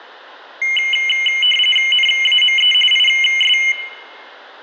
RTTY (45.45 baud, 850 Hz shift), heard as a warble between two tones, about 2550 Hz centre, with room echo. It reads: NAME IS